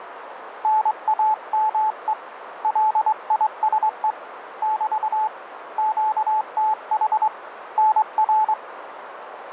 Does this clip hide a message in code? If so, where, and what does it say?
Yes: Morse code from 0.6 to 8.6 s, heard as a keyed tone, hand-sent with a straight key, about 23 wpm, 870 Hz, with radio static and a narrow filter. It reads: NAME LISE <BT> QTH NR